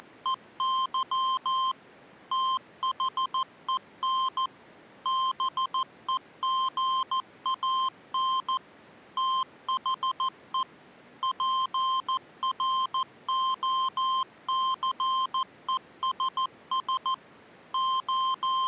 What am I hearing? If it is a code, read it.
Morse code, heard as electronic beeps, machine-sent, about 14 wpm, 1050 Hz. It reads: … THEN BEGAN THE PROCESS …